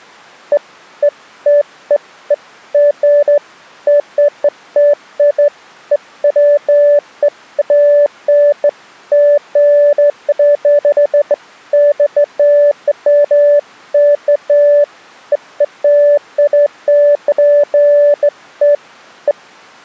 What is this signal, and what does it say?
Beeps of irregular length. There is no code.